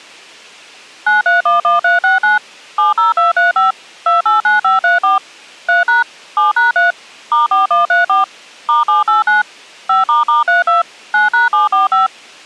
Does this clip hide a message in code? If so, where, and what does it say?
Yes: DTMF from 1.1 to 12.1 s, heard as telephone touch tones, dialled by machine, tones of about 150 ms. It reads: 9311369 70235 289534 3# 7#3 *4134 *789 5**32 9#745